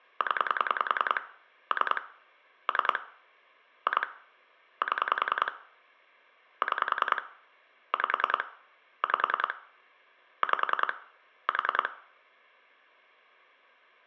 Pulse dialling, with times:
0.2-1.2 0
1.7-2.0 3
2.7-3.0 3
3.9-4.1 2
4.8-5.5 7
6.6-7.2 6
7.9-8.4 5
9.0-9.5 5
10.4-10.9 5
11.5-11.9 4

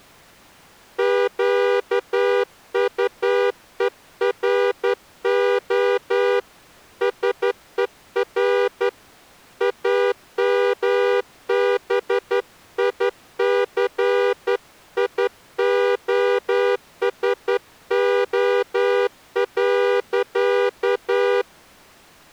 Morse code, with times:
1.0-6.4 QUERO
7.0-8.9 SER
9.6-21.4 AMBICIOSO.

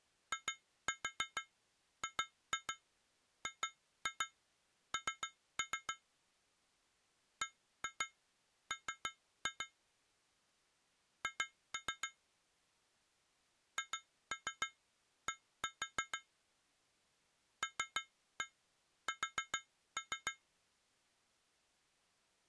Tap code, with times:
0.3-5.9 IGGN
7.4-9.7 BM
11.2-12.1 H
13.8-16.2 HD
17.6-20.3 LS

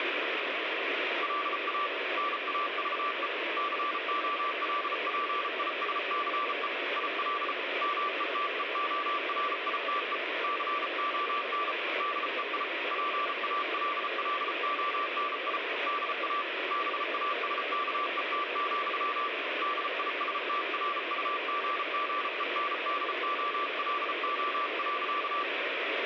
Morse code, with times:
1.2-1.9 LA
2.2-3.3 NAVE
3.6-6.7 COLPISCE
7.0-7.5 IL
7.8-10.2 METEORITE
10.4-11.7 CON
12.0-12.6 DEI
12.9-15.6 PALLONI
15.9-16.4 DA
16.7-19.3 BASKET,
19.6-25.4 DISTRUGGENDOLO.

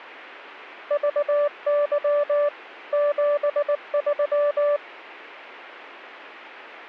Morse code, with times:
0.9-2.5 VY
2.9-4.8 73

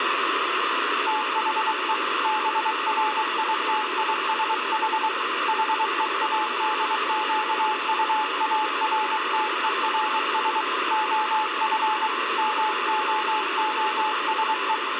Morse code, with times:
1.1-1.9 THE
2.2-5.1 BRITISH
5.5-10.6 HEADQUARTERS
10.9-12.1 OF
12.4-14.7 MOOSE

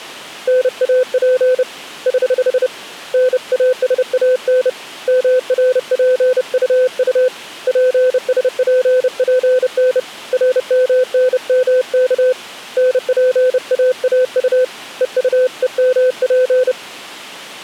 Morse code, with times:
0.5-1.6 NAP
2.1-2.7 <HH>
3.1-4.7 NASAN
5.1-7.3 MRPUU
7.7-10.0 PSPPN
10.3-12.3 RMNMK
12.8-14.6 NPAAU
15.0-16.7 EUEMP

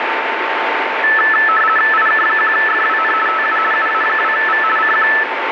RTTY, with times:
1.9-3.1 IK1FWN
3.3-3.6 TU
3.7-4.6 UA2V
4.8-5.1 CQ

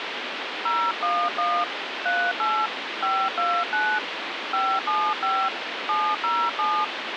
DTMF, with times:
0.7-1.6 011
2.1-2.7 38
3.0-4.0 529
4.5-5.5 575
5.9-6.8 707

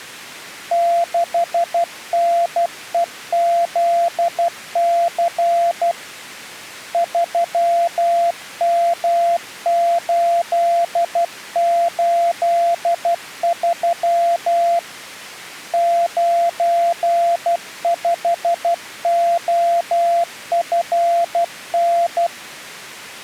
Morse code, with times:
0.7-5.9 6NEZC
6.9-14.8 3M883
15.7-22.3 95OFN

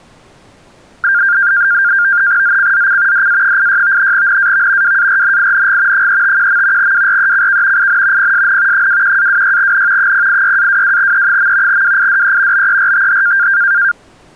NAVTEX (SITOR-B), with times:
2.4-3.3 ZCZC
3.1-4.1 DA86
4.1-5.0 NAV
4.8-6.1 WARNING
5.9-6.9 351.
6.8-7.9 WRECK
7.8-8.3 IN
8.2-8.9 PSN
8.7-10.1 21-26N
10.0-11.8 086-22E.
11.7-12.7 WIDE
12.5-13.5 BERTH

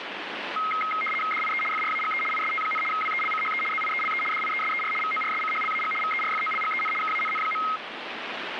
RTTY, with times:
1.3-1.6 DIE
1.7-2.2 FRAGE
2.3-2.8 IST,
2.9-3.6 WELCHE
3.7-4.2 ZIELE
4.3-4.9 DIESER
5.0-5.9 VORSCHLAG
6.0-6.9 VERFOLGEN
7.0-7.6 KANN.

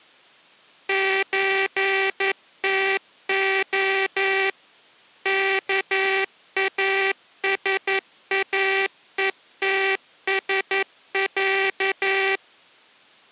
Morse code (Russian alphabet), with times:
0.9-4.5 ЧТО
5.3-12.4 КАСАЕТСЯ

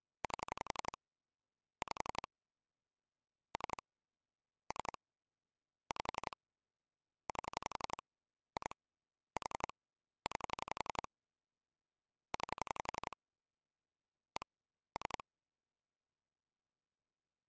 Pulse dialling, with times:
0.2-1.0 8
1.8-2.3 5
3.5-3.8 3
4.7-5.0 3
5.9-6.4 5
7.3-8.0 8
8.6-8.7 2
9.4-9.7 4
10.3-11.1 9
12.3-13.2 9
14.4-14.5 1
15.0-15.2 3

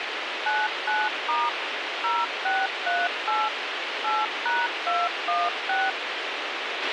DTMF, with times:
0.5-1.5 99*
2.0-3.5 0638
4.0-5.9 8#216

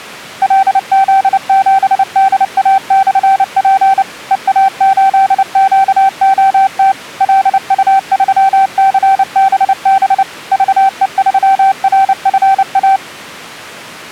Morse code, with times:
0.4-4.0 LZ7DA/P
4.3-6.9 EA8QOT
7.2-10.2 LU3CBB
10.5-13.0 VE3RFA

